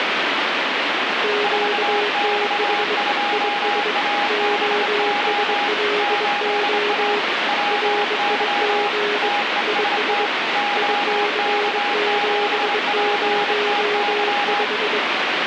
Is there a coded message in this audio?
Yes: Morse code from 1.2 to 15.0 s, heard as two keyed tones, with heavy radio static. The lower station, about 22 wpm, 420 Hz: QTH IS OSLO RIG IS IC705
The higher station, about 26 wpm, 820 Hz: 4X2ABO 8A WY TEST OK7PTY